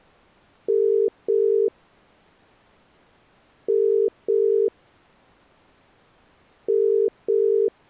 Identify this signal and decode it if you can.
Telephone call progress tone (as in the UK, Ireland, Australia and similar networks), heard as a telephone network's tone, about 400, 450 Hz. Ringback tone.